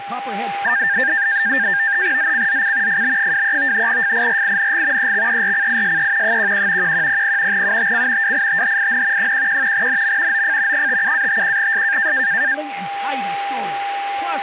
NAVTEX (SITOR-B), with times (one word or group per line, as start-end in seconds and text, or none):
2.2-3.0 ZCZC
2.9-3.9 FB23
3.9-5.1 FIRING
5.0-6.4 EXERCISE
6.2-6.9 11
6.8-7.6 1100
7.5-8.3 UTC
8.2-9.3 WITHIN
9.2-9.9 11
9.7-10.4 NM
10.3-10.9 OF
10.7-12.1 57-51S